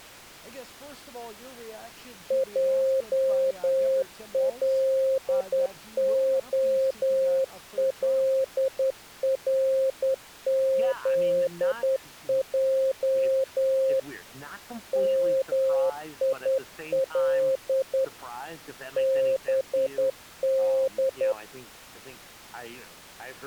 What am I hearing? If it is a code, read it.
Morse code, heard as a keyed tone, hand-sent with a straight key, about 10 wpm, 530 Hz. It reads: JLOLRZJ MIL BD